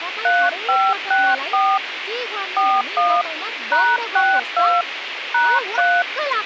DTMF, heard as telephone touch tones, dialled by hand, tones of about 250 ms, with radio hiss and speech in Nepali. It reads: 3564 41 #62 #3